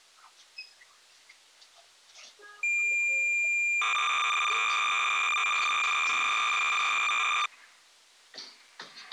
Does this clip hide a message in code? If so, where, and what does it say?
Yes: cassette data (Kansas City type), 300 baud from 2.6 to 7.5 s, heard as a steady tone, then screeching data, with the noise inside a lift.